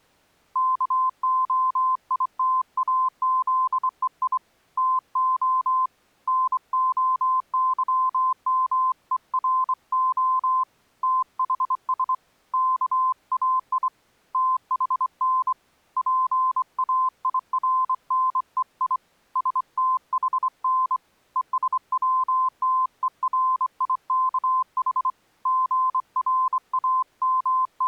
Morse code (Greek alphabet), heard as a keyed tone, hand-sent with a straight key, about 24 wpm, 1030 Hz. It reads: ΚΟΙΤΑΖΕΙ ΤΟ ΝΟΥΜΕΡΟ ΤΗΣ ΚΑΙ ΤΗΝ ΠΑΙΡΝΕΙ ΣΤΗΝ ΕΣΩΤΕΡΙΚΗ …